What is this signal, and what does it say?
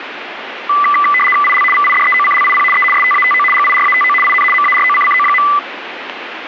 RTTY (75 baud, 850 Hz shift), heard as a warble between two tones, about 1600 Hz centre, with radio static. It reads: IL VIDEOCLIP E STATO GIRATO IN MAROCCO.